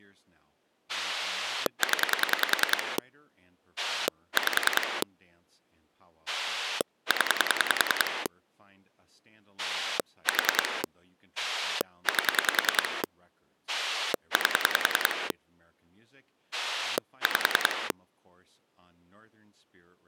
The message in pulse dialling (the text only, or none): 0 5 0 4 8 8 5